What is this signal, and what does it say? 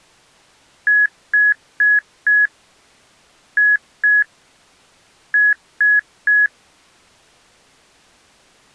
Beep code, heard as beeps, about 1700 Hz. 4-2-3. In Phoenix BIOS tables: gate A20 failure.